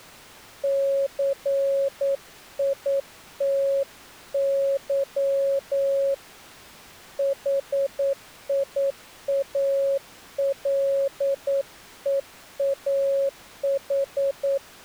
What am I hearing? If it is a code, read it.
Morse code, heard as a keyed tone, hand-sent with a paddle, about 9 wpm, 550 Hz. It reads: CITY HIALEAH